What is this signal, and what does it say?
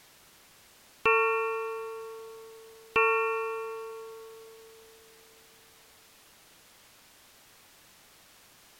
Clock strike, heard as a bell. 2. Two o'clock.